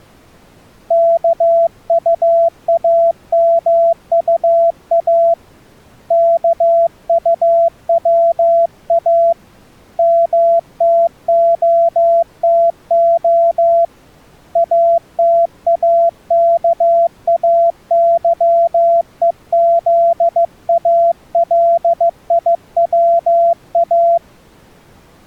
Morse code, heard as a keyed tone, hand-sent with a paddle, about 15 wpm, 680 Hz. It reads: KUAMUA KUWA MTOTO ATAKAYEZALIWA